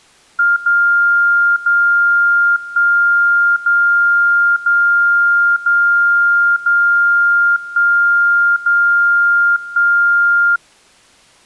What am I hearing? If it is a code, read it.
Radio time signal (DCF77), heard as a tone whose level steps once a second, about 1400 Hz. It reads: 0 0 1 0 0 0 0 1 0 1